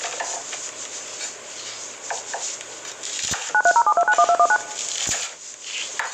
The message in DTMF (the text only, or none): 9307291219